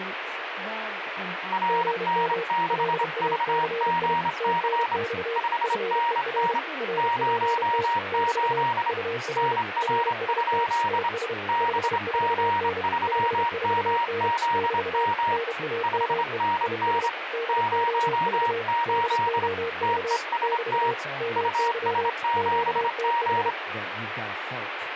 Morse code, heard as two keyed tones, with radio static and speech in English. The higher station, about 26 wpm, 940 Hz: RN6VGC 5NN 08 NR? BG3MZM 5NN 08 TEST US7G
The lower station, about 31 wpm, 460 Hz: GM LACI TNX FER RPT <BT> UR RST IS 54N 54N <BT> NAME IS DOV DOV <BT> MY QTH